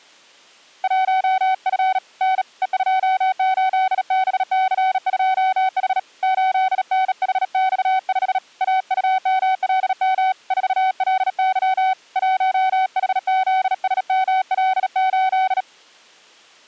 Morse code, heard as a keyed tone, hand-sent with a bug key, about 37 wpm, 760 Hz. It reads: 1F N E28BC2H 8NHX5 AUMLM 4LY 1HZSML8